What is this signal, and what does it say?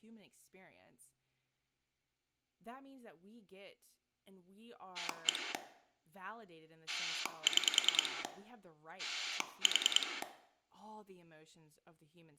Pulse dialling, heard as a rotary dial, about 10 pulses a second, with room echo and speech in English. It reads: 1 6 4